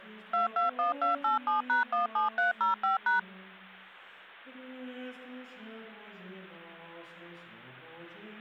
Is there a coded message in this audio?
Yes: DTMF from 0.3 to 3.2 s, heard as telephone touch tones, dialled by machine, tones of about 140 ms. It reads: 221287#17305#